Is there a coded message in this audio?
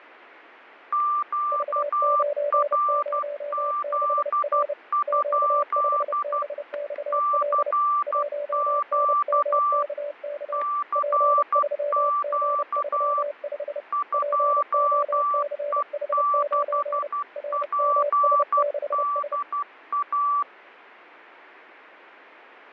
Yes: Morse code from 0.9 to 20.5 s, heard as two keyed tones, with static crashes. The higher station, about 12 wpm, 1170 Hz: QRZ? CQ CQ 2E6PDA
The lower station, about 30 wpm, 580 Hz: V906R Q5BXL 1NMKK P3G35 POCH9 RMS6S